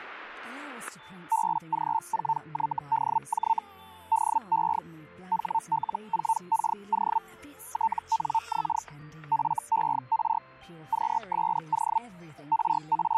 Hellschreiber (Feld-Hell, 122.5 baud), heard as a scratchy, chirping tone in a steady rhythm, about 900 Hz, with static crashes. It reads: BG4YDJ DE HL4KO TNX FER QSO …